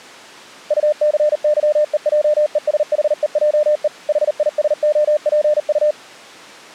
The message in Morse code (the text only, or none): UCYEJESHEJE HISOPU